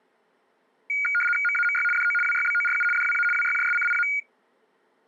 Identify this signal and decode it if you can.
RTTY (75 baud, 850 Hz shift), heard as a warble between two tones, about 1850 Hz centre. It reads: MAMY DO WYBORU DWA WYJSCIA